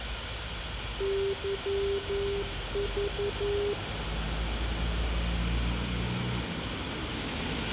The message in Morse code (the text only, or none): YV